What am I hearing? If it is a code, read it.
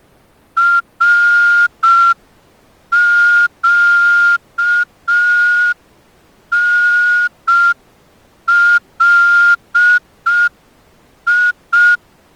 Morse code, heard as a whistle, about 5 wpm. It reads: RQNLI